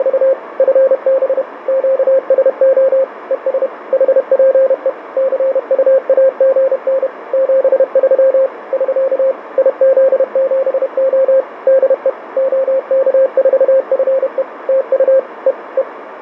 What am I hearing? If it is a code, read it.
Morse code, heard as a keyed tone, machine-sent, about 31 wpm, 530 Hz, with radio static. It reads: … FB QSO ES HPE CUAGN 73 <SK> IZ7O DE OK4FE TU E E